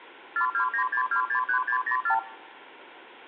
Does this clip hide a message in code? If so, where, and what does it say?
Yes: multi-frequency trunk signalling (R2, with the far end's replies) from 0.4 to 2.2 s, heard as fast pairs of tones, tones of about 90 ms. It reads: 4296263604